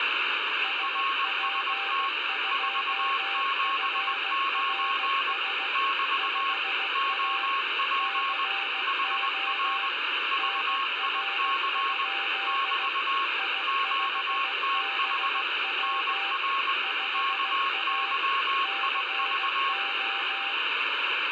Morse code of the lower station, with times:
0.6-5.7 SP2FRS
6.2-7.5 5A
8.0-9.9 CO
10.4-12.9 NR?
13.4-16.3 I5BW
16.8-18.1 5A
18.6-20.5 CO

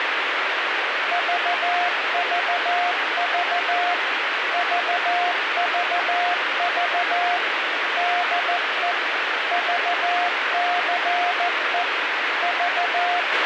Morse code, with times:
1.1-3.9 VVV
4.5-7.4 VVV
8.0-8.9 DE
9.5-11.8 VCE
12.4-13.5 …

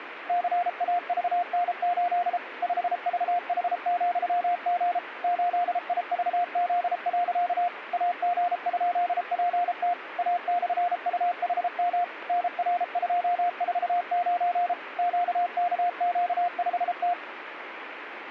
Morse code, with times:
0.3-2.4 CAVN8
2.6-5.0 5VH,G
5.2-7.7 8IVZ.
7.9-9.9 AG?PT
10.2-12.0 A/UHM
12.3-14.7 NR249
15.0-17.1 QKQ5T

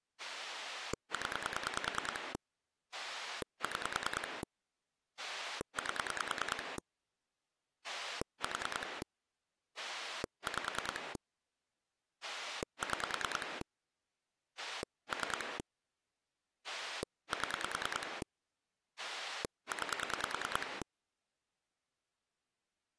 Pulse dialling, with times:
0.2-2.3 0
2.9-4.4 6
5.2-6.8 8
7.8-9.0 4
9.8-11.2 5
12.2-13.6 6
14.6-15.6 3
16.7-18.2 7
19.0-20.8 9

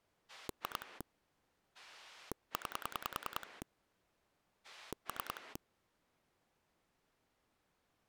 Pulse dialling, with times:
0.3-1.0 2
1.7-3.6 9
4.6-5.6 3

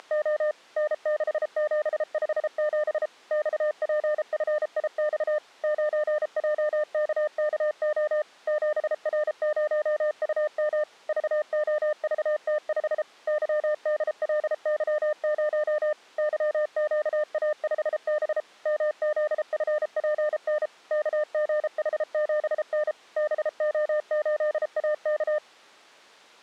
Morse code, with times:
0.0-0.5 …
0.8-3.1 N6757
3.3-5.4 XPFIX
5.6-8.2 9JKKO
8.5-10.8 7R0UM
11.1-13.0 VOVT5
13.3-15.9 YDLY0
16.2-18.4 YQA5B
18.7-20.7 MZFPN
20.9-22.9 KGH7N
23.2-25.4 BO8AK

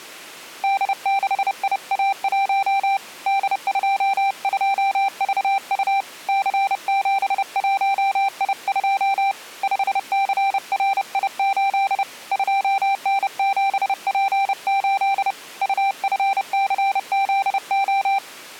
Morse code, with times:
0.6-3.0 D6IA1
3.3-6.0 D22VU
6.3-9.3 C71I2
9.6-12.0 5CRI8
12.3-15.3 2N7P8
15.6-18.2 UFCZO

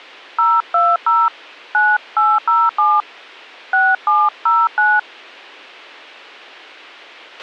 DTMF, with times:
0.4-1.3 020
1.7-3.0 9807
3.7-5.0 6709

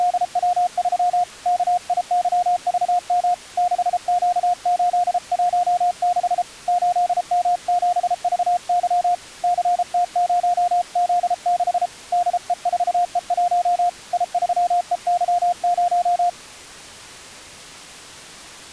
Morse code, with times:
0.0-1.2 …
1.5-3.3 KIYVM
3.6-6.4 6Q816
6.7-9.1 8M7VY
9.4-11.9 CT0Z6
12.1-13.9 DE4E1
14.1-16.3 I3EY0

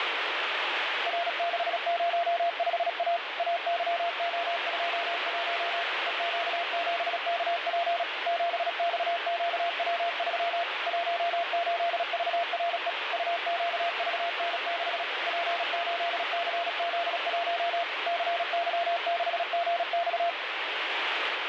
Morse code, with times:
1.1-3.2 R605A
3.4-5.8 AYO21
6.1-8.0 EQ7KP
8.3-10.6 7XQW3
10.9-12.9 18VRE
13.1-15.0 UQVN6
15.3-17.8 P8CZ1
18.1-20.3 CY6GX

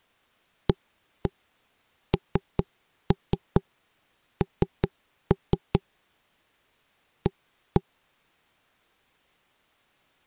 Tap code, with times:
0.7-5.8 ANN
7.3-7.8 A

